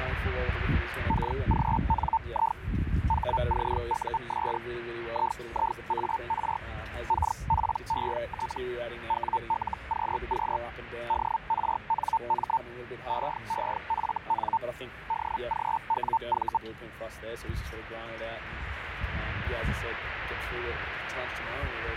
Hellschreiber (Feld-Hell, 122.5 baud), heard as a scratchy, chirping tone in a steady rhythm, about 900 Hz, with radio static. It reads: KGNI HCUS IIAR KPET WLQQ DRNM EEFN DGWV